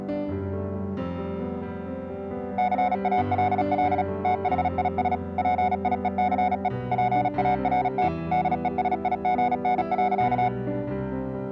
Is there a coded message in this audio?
Yes: Morse code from 2.5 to 10.5 s, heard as a keyed tone, machine-sent, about 36 wpm, 730 Hz. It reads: CALL THIS PIECE PART DESIGN.